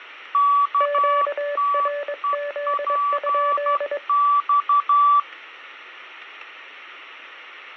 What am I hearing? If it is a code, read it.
Morse code, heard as two keyed tones, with radio static. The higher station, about 12 wpm, 1150 Hz: KTEPX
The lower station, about 22 wpm, 580 Hz: QRZ?